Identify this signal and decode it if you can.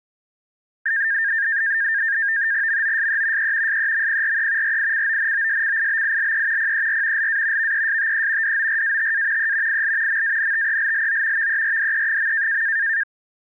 NAVTEX (SITOR-B), 100 baud, 170 Hz shift, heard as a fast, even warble, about 1700 Hz centre. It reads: MOSE E SEMPRE RICONOSCIBILE PER LA VESTE DORATA E IL MANTELLO VERDE.